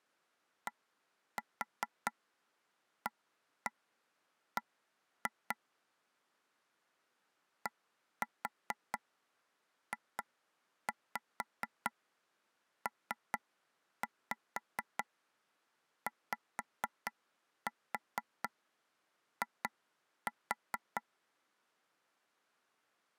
Tap code, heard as taps on a table, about 4 knocks a second. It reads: DAB DJPYI